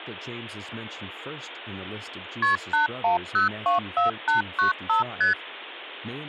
Multi-frequency trunk signalling (R1, as on North American trunks), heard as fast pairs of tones, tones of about 130 ms, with speech in English. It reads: KP 81024895 ST